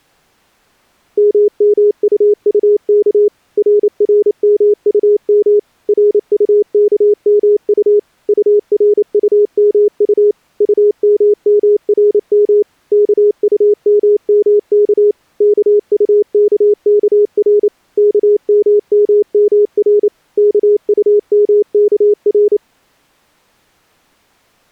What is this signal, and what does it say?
Morse code, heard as a keyed tone, machine-sent, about 28 wpm, 420 Hz. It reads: MMUUK RRMUM RUKMU URUMU UMMRM KUMMK KUKKR KMMMR KUMKR